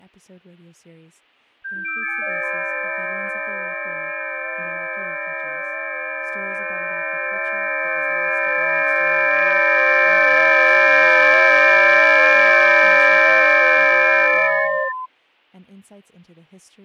FT8 (several signals at once), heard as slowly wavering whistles, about 6.25 baud, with fading.